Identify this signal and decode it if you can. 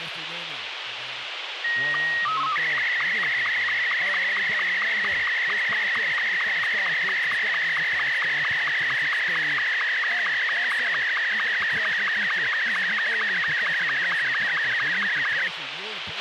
SSTV (slow-scan television), Martin M2, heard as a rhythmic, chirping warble, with radio hiss and a squelch burst at the end.